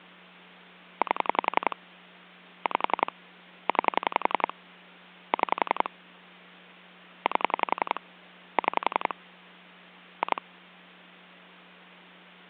Pulse dialling, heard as clicks on a phone line, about 11 pulses a second, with hum. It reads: 8 5 9 6 8 6 2